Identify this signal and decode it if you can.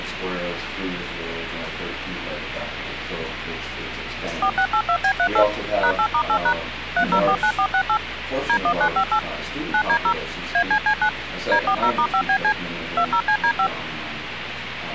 DTMF, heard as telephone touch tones, dialled by machine, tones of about 80 ms, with phone line noise. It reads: 4682B38 #8*8# 3049468 D1958 9D0 ACC9 D40*5BC 20CD5